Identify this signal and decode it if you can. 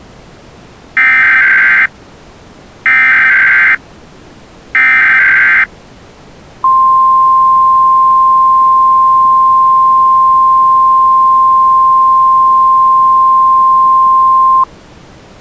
Emergency Alert System (SAME) tones (header bursts, then the 1050 Hz attention tone), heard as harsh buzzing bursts, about 520.83 baud.